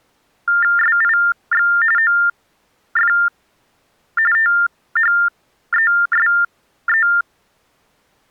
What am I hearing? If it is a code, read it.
TTY/TDD text telephone tones (45.45 baud Baudot), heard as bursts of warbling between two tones, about 400 Hz shift, 1600 Hz centre. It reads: SIX OF THESE